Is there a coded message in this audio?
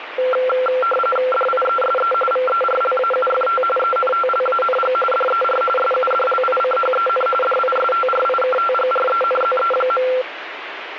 Yes: RTTY (45.45 baud, 850 Hz shift) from 0.2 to 10.2 s, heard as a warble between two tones, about 940 Hz centre, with radio static. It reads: DIESE VERLAUFT ENTLANG DER SUDLICHEN DISTRIKTGRENZE.